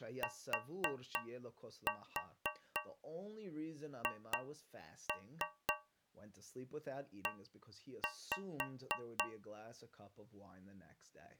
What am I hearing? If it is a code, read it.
Tap code, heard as taps on a metal pipe, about 3 knocks a second, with speech in English. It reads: THE